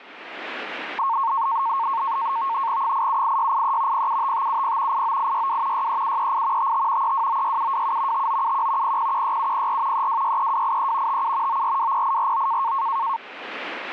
NAVTEX (SITOR-B), 100 baud, 170 Hz shift, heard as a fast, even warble, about 1000 Hz centre. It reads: 878683 075570 89862 63738 55 3296727 5971 0016704 3263283 57 9420849